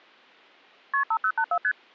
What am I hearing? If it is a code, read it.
Multi-frequency trunk signalling (R1, as on North American trunks), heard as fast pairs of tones, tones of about 70 ms. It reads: KP 5084 ST